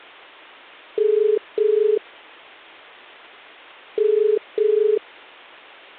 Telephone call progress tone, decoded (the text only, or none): ringback tone